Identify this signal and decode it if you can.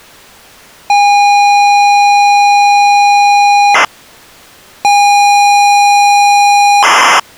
ZX Spectrum tape loading, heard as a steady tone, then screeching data.